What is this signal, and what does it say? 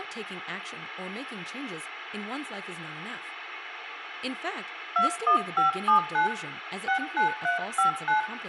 DTMF, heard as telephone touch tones, dialled by hand, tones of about 120 ms, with phone line noise, room echo and speech in English. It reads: 21579 69359